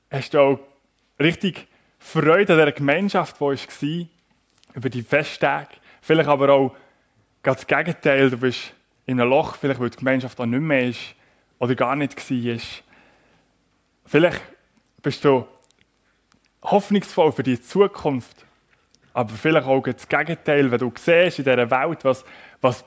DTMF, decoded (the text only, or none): none